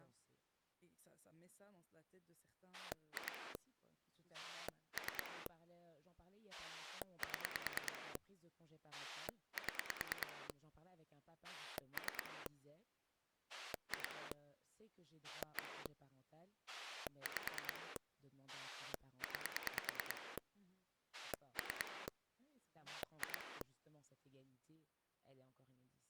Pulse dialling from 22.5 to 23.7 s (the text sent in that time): 2